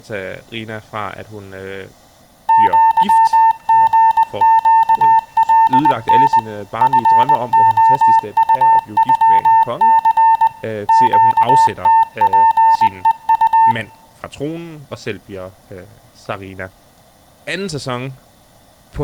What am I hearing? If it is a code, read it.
Morse code (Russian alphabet), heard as a keyed tone, machine-sent, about 20 wpm, 900 Hz, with speech in Danish. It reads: ЪГЩЛН ФОУЮЦ ЩТПЕУ